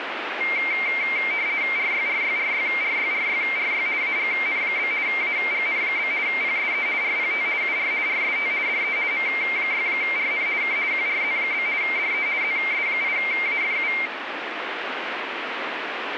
RTTY (50 baud, 170 Hz shift), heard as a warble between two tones, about 2200 Hz centre, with radio static. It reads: RYRYRYRYRYRY AGN? AGN? PSE RPT UR RST DE M6RN K QRZ? DE ZS8AFU